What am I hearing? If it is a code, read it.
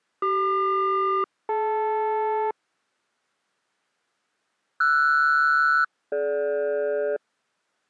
Aircraft SELCAL, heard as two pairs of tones. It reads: CQ-DL RS-DG